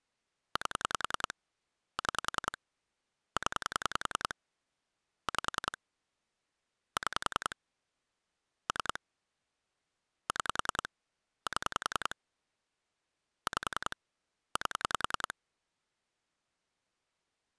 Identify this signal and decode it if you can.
Pulse dialling, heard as clicks on a phone line, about 10 pulses a second. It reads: 8 6 0 5 6 3 6 7 5 8